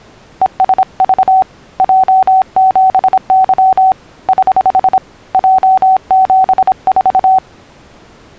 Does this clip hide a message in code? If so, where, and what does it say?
Yes: Morse code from 0.4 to 7.4 s, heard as a keyed tone, hand-sent with a paddle, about 26 wpm, 760 Hz. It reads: ESV J7Y <HH> J74